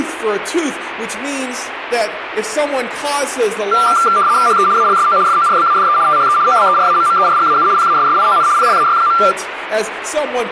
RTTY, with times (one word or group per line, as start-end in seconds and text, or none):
4.5-4.7 HE
4.8-5.2 ALSO
5.3-6.0 FORBADE
6.1-6.4 THE
6.5-7.7 OBERAMMERGAU
7.8-8.5 PASSION
8.6-9.2 PLAY.